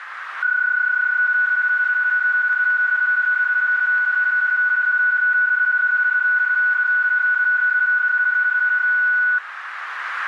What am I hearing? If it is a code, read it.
PSK31 (31.25 baud), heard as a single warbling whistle, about 1480 Hz, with radio static and a narrow filter.